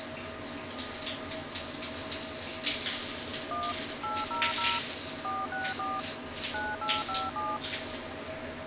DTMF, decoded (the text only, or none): 1 800 464 9857